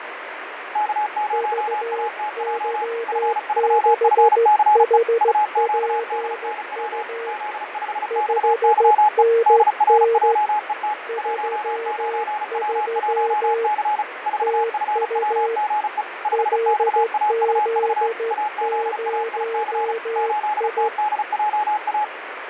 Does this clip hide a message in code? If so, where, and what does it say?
Yes: Morse code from 0.7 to 22.1 s, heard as two keyed tones, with radio static and fading. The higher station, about 35 wpm, 840 Hz: K0ATJ F3FCE UQDNW Z5XYE DRJET 19W1C 4FWGE 5XAUV AZAIC 8TDJA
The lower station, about 14 wpm, 460 Hz: VY6HPU 5NN 33 TU LZ0I